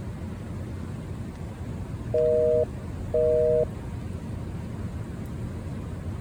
Telephone call progress tone (North American plan), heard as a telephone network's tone, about 480, 620 Hz, 0.5 s on and 0.5 s off. Busy tone.